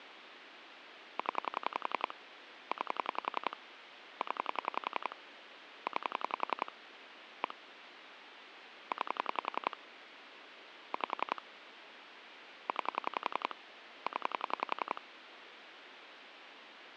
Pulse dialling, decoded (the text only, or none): 0 9 0 9 1 9 5 9 0